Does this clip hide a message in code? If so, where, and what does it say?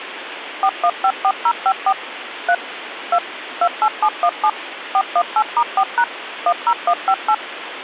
Yes: DTMF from 0.6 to 7.3 s, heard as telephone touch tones, dialled by machine, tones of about 60 ms, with phone line noise. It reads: 4154054 3 2 28717 418*4# 10158